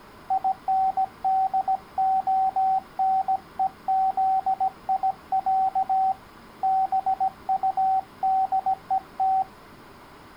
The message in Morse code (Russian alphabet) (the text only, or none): ИНДОНЕЗИЯ БУДЕТ